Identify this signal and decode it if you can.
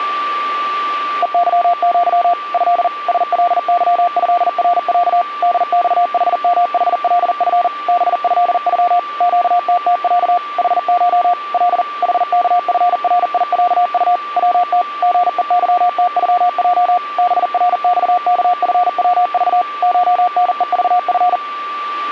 Morse code (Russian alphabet), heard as a keyed tone, machine-sent, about 40 wpm, 710 Hz, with a steady whistle near 1170 Hz. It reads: ЕЫЪ Э СЛЫЭРЯ ДЬХМХЛФ БЭЮ ЩТТЯ ХШ Л ХКФРИЯУ ВТ ГЕЫТЮЙ БРЬКФВЖ ШНЕЖФ